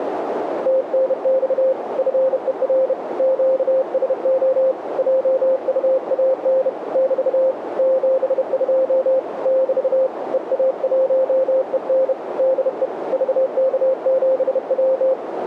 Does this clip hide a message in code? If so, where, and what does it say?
Yes: Morse code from 0.6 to 15.2 s, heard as a keyed tone, hand-sent with a bug key, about 31 wpm, 530 Hz, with radio static and a narrow filter. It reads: TNX FER QSO JUAN <BT> 72 <BT> EA1EN DE VK7W